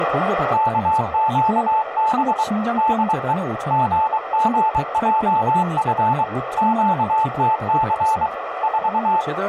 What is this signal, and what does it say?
Morse code, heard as a keyed tone, hand-sent with a paddle, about 23 wpm, 880 Hz, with radio static, a narrow filter and speech in Korean. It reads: KQB DE GGJF QTC 4